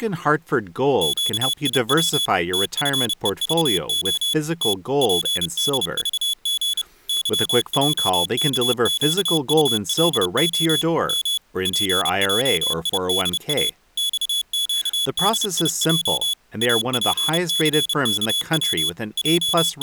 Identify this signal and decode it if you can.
Morse code, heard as a high beeper, machine-sent, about 30 wpm, 3400 Hz, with speech in English. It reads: QIW TFEVO T PDVG YJKQULO M PJIDA XQDIJ APCKW …